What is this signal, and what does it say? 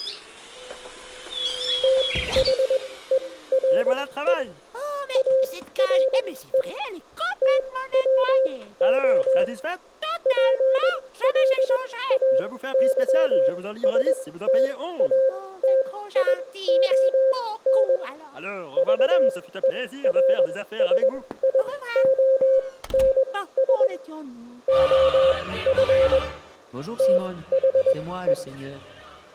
Morse code, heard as a keyed tone, machine-sent, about 21 wpm, spaced as for 15 wpm, 530 Hz, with room echo. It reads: THERE ARE TWO PLAYSTATION VERSIONS OF THE